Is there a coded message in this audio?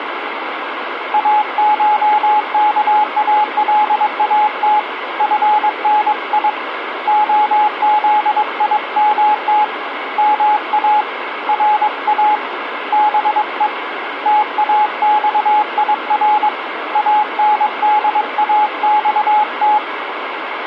Yes: Morse code (Persian alphabet) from 1.1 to 19.8 s, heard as a keyed tone, hand-sent with a paddle, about 22 wpm, 840 Hz, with radio static. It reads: اشکالات فنی عزیمت ما را به تاخیر انداخت